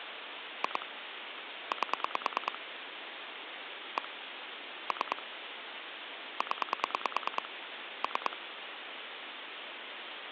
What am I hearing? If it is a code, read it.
Pulse dialling, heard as clicks on a phone line, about 9 pulses a second, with phone line noise. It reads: 2 8 1 3 0 3